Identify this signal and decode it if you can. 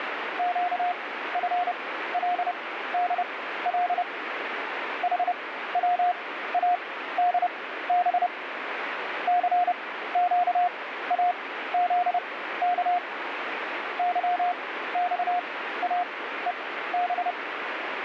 Morse code, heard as a keyed tone, machine-sent, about 30 wpm, spaced as for 15 wpm, 710 Hz, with radio static. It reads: QFLDL HWADB CQAZK YXAEB